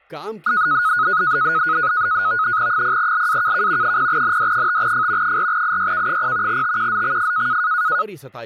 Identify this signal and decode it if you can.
NAVTEX (SITOR-B), 100 baud, 170 Hz shift, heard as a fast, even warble, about 1360 Hz centre, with speech in Urdu. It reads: 0LAKK 0ND5F 4IYK0 TQZXF